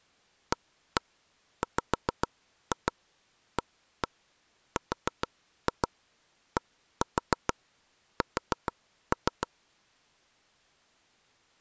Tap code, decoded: AWARDS

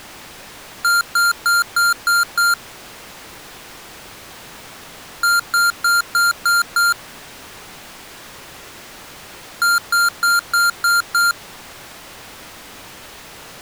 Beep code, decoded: 6 short

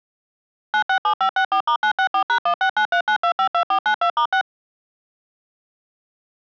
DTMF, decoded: 967564*964#16939252492*6

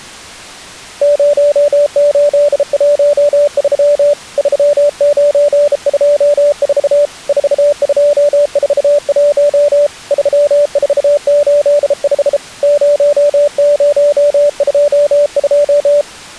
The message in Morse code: 0813 3924 4241 3485 0022

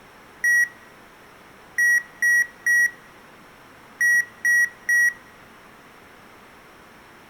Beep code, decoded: 1-3-3

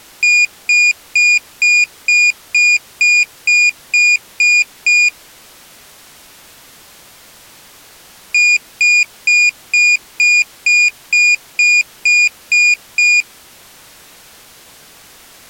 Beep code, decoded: 11 short

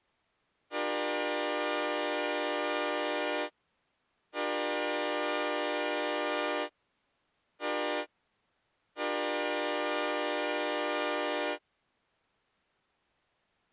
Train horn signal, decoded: 2 long, 1 short, 1 long

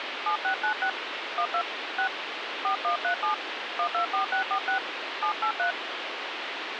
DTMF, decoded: 7696 12 6 4137 124646 783

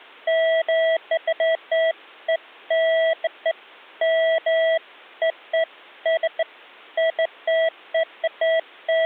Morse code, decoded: none

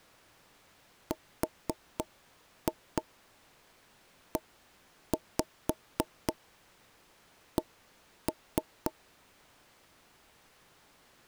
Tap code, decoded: REC

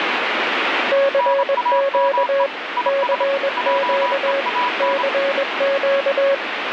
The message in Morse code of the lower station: CQ CQ CQ

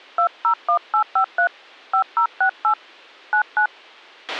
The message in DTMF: 201853 5068 99

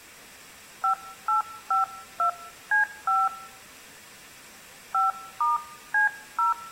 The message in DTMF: 5852C5 5*C0

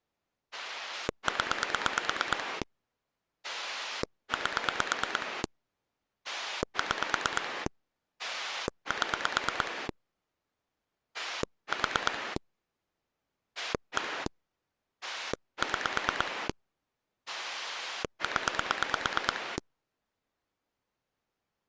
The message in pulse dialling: 0 8 6 7 4 1 6 0

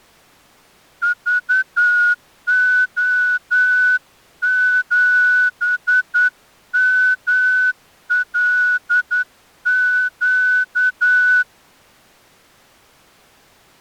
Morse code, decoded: VO7MLQ

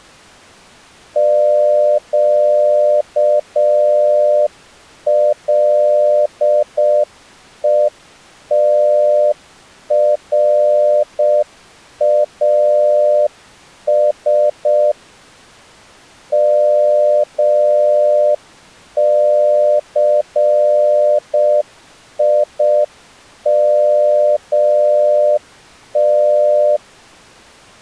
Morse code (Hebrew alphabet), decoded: קלותראש מסימת

